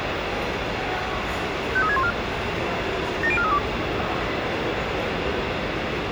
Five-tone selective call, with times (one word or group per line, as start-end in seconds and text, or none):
1.8-2.1 53614
3.2-3.6 70432